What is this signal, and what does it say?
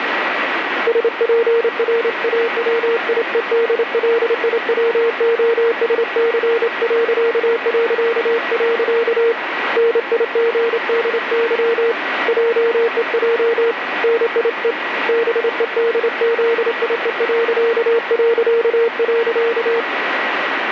Morse code, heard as a keyed tone, hand-sent with a straight key, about 28 wpm, 460 Hz, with radio static. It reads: SPRAWIEDLIWOSC... NIGDY JEJ NIE BEDZIE...